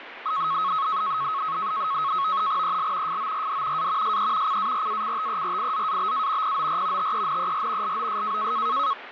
NAVTEX (SITOR-B), 100 baud, 170 Hz shift, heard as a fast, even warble, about 1190 Hz centre, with radio static and speech in Marathi. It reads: EL FORD A SE CARACTERIZABA POR TENER LOS